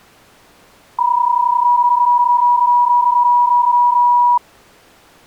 PSK31 (31.25 baud), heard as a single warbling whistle, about 970 Hz.